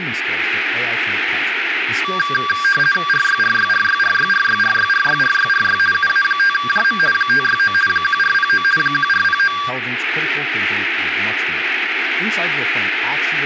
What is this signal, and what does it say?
RTTY (50 baud, 450 Hz shift), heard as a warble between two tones, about 1380 Hz centre, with radio static and speech in English. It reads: RYRYRYRYRYRYRYRYRY UA5JM 569 1409 1409